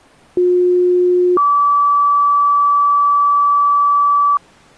Two-tone page, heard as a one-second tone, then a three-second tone, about 360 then 1150 Hz.